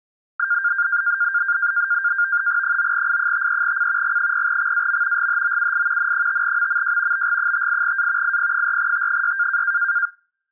NAVTEX (SITOR-B), 100 baud, 170 Hz shift, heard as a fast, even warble, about 1500 Hz centre. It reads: 9I53C G0XAM GHOUI N5MMJ BG58A IP4T6